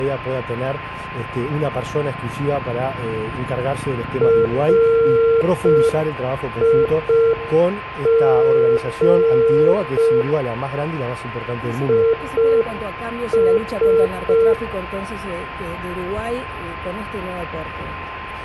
Morse code, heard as a keyed tone, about 5 wpm, 460 Hz, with a steady whistle near 1040 Hz and room echo. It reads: RIG IS